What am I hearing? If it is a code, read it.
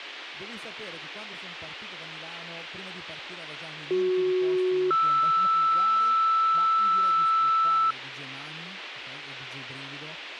Two-tone page, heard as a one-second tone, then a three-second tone, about 370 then 1320 Hz, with radio hiss and a squelch burst at the end.